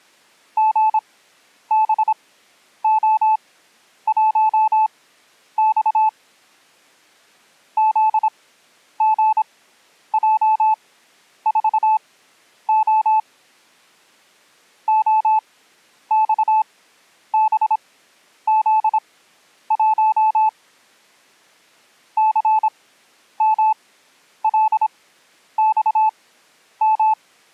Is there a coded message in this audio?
Yes: Morse code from 0.5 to 27.2 s, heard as a keyed tone, machine-sent, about 26 wpm, spaced as for 10 wpm, 870 Hz. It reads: GBO1X ZGJ4O OXBZ1 CMLXM